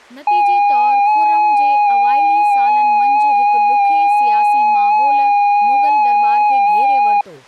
FT8 (one signal), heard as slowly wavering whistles, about 6.25 baud, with speech in Sindhi.